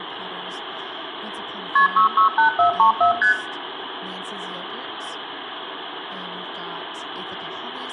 Multi-frequency trunk signalling (R1, as on North American trunks), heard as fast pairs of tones, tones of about 110 ms, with phone line noise, room echo and speech in English. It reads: KP 668434 ST